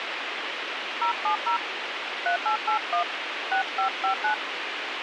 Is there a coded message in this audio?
Yes: DTMF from 1.0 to 4.3 s, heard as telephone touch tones, dialled by hand, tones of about 100 ms, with radio hiss. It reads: 070 3881 6559